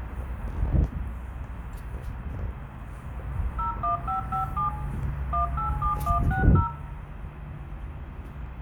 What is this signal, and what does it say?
DTMF, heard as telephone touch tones, dialled by machine, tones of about 120 ms, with room echo and the noise of a residential street. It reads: 01557 187160